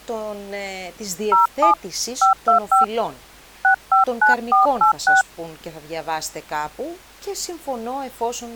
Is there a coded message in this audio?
Yes: DTMF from 1.3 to 5.2 s, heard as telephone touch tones, dialled by hand, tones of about 120 ms, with speech in Greek. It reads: 07 525 659486